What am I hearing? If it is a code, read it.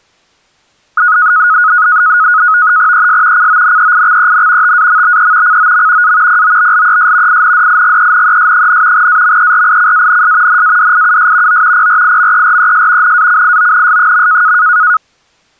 NAVTEX (SITOR-B), 100 baud, 170 Hz shift, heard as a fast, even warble, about 1360 Hz centre. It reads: ES CONEIXEN TAMBE COM A POBLES INDIGENES, AMERICANS NADIUS O PRIMERES NACIONS.